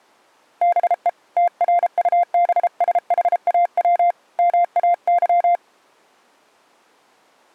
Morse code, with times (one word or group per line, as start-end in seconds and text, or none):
0.6-1.1 BE
1.4-4.1 TRUBSHAW
4.4-5.6 MAY